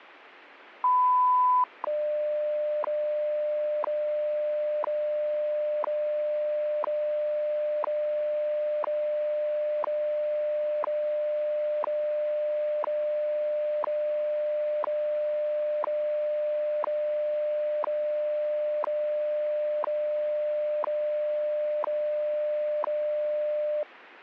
Radio time signal (WWV, Colorado), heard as ticks, one a second.